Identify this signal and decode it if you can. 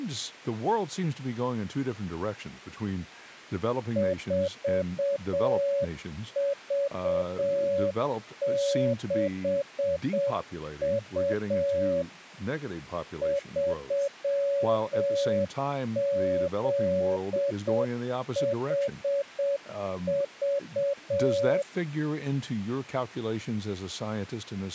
Morse code, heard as a keyed tone, machine-sent, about 7 wpm, 560 Hz, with speech in English. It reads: 4V6U 3ZHV